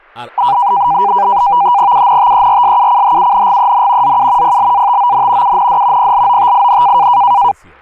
NAVTEX (SITOR-B), 100 baud, 170 Hz shift, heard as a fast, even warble, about 890 Hz centre, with speech in Bangla. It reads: UNTERSUCHUNGEN ZU PLATON UND PLOTIN